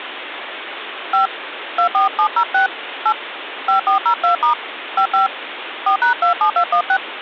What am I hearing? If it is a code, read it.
DTMF, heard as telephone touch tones, dialled by hand, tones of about 100 ms, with phone line noise. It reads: 5 24706 8 5402* 55 4#27216